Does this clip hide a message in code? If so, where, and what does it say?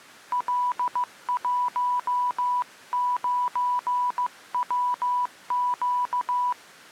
Yes: Morse code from 0.3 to 6.6 s, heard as a keyed tone, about 15 wpm, 990 Hz. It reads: L19WQ